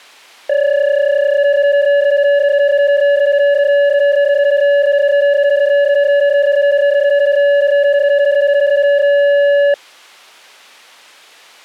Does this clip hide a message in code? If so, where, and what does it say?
Yes: PSK31 (31.25 baud) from 0.5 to 9.7 s, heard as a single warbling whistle, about 570 Hz.